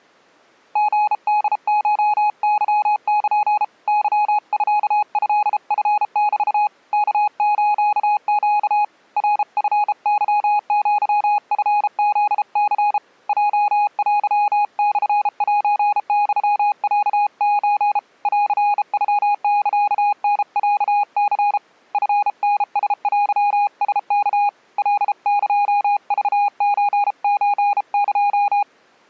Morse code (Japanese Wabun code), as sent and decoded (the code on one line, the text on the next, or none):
--. -.. ---- -.-- -.--. / -.-- ..-.- ..-.. ..-. -...- / -.- ---.- --.- / .-. ..-. -.-- --.-- ..-. --.. -.-. / .--- .-.-- -..-. .---. -..-- .-.- ---. / .-.-. ..-- -.-.- -. .-.- -.-. / ..-. -. ... .-.-- ... -.- / .-.. -.--- ...- ---. ---. -.---
リホコケル ケミトチメ ワスネ ナチケアチフニ ヲテモセユロソ ンノサタロニ チタラテラワ カエクソソエ